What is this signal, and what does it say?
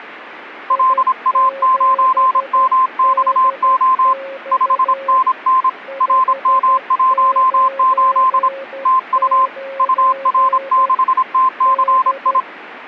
Morse code, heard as a keyed tone, hand-sent with a paddle, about 26 wpm, 1040 Hz, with a weaker station near 540 Hz. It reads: LA9MXO 5NN RM18 TU UR6TCI